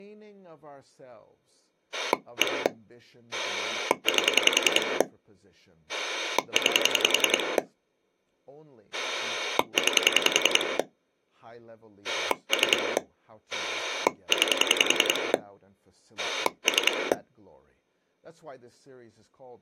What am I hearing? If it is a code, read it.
Pulse dialling, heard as a rotary dial, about 10 pulses a second, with speech in English. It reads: 1 8 9 9 3 9 3